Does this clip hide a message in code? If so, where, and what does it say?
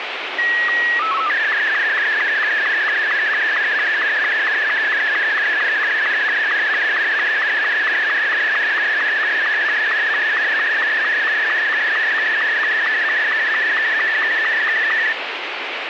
Yes: SSTV (slow-scan television), Martin M2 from 0.4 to 15.1 s, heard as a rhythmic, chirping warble, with radio static.